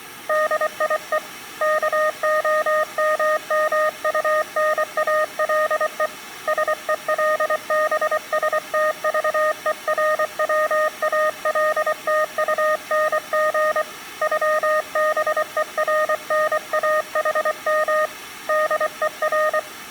Morse code (with German letters), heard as a keyed tone, hand-sent with a paddle, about 24 wpm, 620 Hz, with room echo. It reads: DIE KOMMUNALE SELBSTVERWALTUNG ÜBERNAHM DER